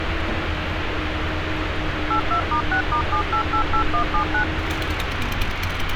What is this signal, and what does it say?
DTMF, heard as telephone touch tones, dialled by machine, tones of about 90 ms, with radio hiss and street noise. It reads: 82*6*7888179